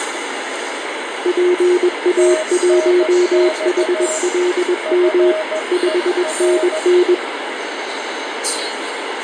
Morse code, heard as two keyed tones, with radio static and the noise inside a subway train. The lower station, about 21 wpm, 360 Hz: PA1HLM 5NN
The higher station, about 15 wpm, 630 Hz: TNX FER